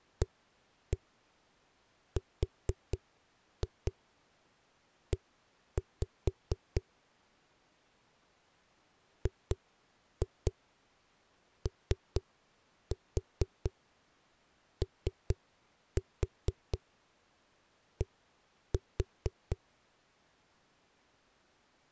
Tap code, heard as knocks on a wall, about 4 knocks a second. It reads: ARE GOOD